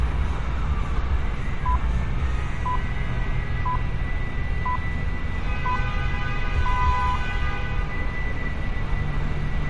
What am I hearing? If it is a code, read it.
Radio time signal (six pips, as the Greenwich Time Signal), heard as pips, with street noise.